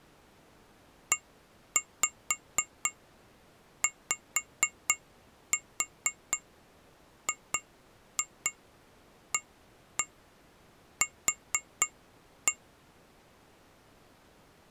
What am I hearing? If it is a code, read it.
Tap code, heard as taps on glass, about 4 knocks a second. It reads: EYGAQ